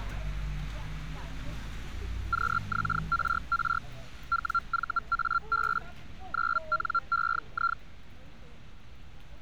Hellschreiber (Feld-Hell, 122.5 baud), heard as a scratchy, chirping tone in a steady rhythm, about 1370 Hz, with street noise. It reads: QXRR WVAB 9NEI